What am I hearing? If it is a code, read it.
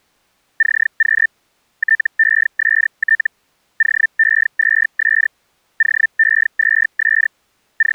Hellschreiber (Feld-Hell, 122.5 baud), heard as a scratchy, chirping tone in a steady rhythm, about 1800 Hz. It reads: CQ TEST OE2S OE2S …